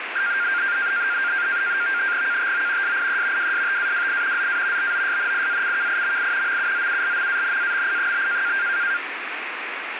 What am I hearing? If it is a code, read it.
NAVTEX (SITOR-B), 100 baud, 170 Hz shift, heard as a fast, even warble, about 1500 Hz centre, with radio static. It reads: KTO SIE WSTAWI ZA BOSNIACKIMI MUZULMANAMI?